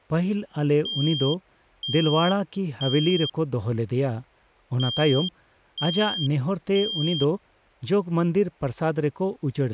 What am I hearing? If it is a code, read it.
Alarm pattern, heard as an alarm's beeps, played twice, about 3200 Hz, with speech in Santali. Temporal three. Smoke or fire, evacuate.